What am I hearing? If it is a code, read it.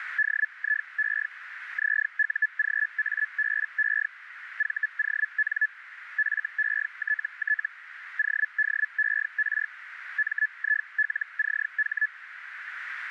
Hellschreiber (Feld-Hell, 122.5 baud), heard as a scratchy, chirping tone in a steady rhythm, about 1700 Hz, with radio static and a narrow filter. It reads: DIE ZUGABE VON FETT ODER MILCH